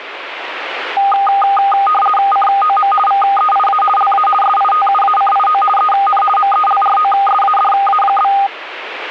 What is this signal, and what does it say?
RTTY (50 baud, 450 Hz shift), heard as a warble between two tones, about 1020 Hz centre, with radio static. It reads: COM VEIA LA SITUACIO EN MELROSADA?